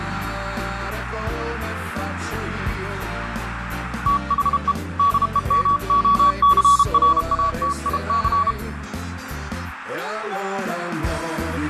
Morse code, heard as a keyed tone, hand-sent with a paddle, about 32 wpm, 1130 Hz, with radio static. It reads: THE DEMOCRATIC